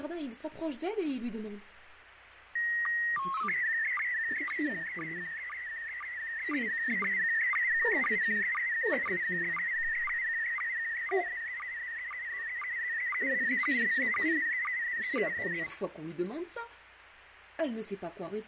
SSTV (slow-scan television), PD 120, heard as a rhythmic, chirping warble, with radio static and fading.